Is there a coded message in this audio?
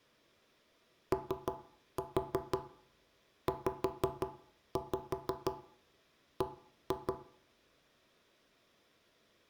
Yes: tap code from 1.1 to 7.2 s, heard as knocks on wood, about 6 knocks a second, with room echo. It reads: OZB